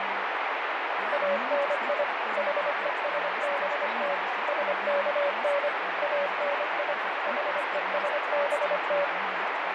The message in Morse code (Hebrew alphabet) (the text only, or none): אני חושבת שכן אני חושבת